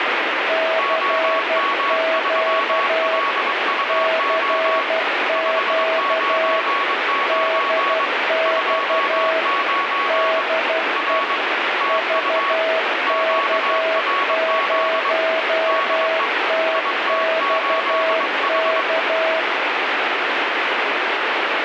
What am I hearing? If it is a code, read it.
Morse code, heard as two keyed tones, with heavy radio static. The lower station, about 12 wpm, 650 Hz: CQ CQ DX DE VK0TXK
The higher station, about 22 wpm, 1120 Hz: OM3LUO 599 29 R TU QRZ DE IT8H